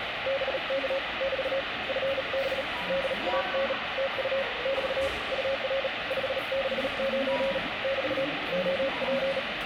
Morse code, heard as a keyed tone, hand-sent with a bug key, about 37 wpm, 540 Hz, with radio static and the noise of a subway station. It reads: BK <BT> FB DAN TU <BT> UR 569 <BT> OP